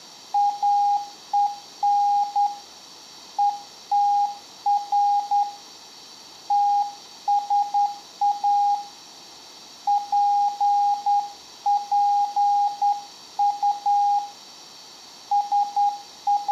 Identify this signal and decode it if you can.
Morse code, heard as a keyed tone, hand-sent with a straight key, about 10 wpm, 820 Hz, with room echo. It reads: AEN ETR TSA PPU …